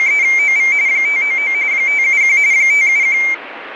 RTTY (45.45 baud, 170 Hz shift), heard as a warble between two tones, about 2200 Hz centre, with radio static. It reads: … 599 571 571